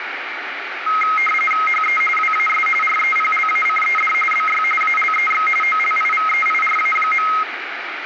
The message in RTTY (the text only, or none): HE WAS REPLACED BY ALEX OLIVEIRA.